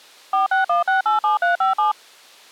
DTMF, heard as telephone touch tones, dialled by machine, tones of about 140 ms. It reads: 461687357